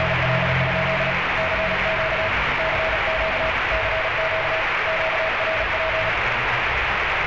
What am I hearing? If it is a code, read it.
Morse code, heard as a keyed tone, hand-sent with a paddle, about 36 wpm, 640 Hz, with heavy radio static and street noise. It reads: … CQ CQ CQ QRP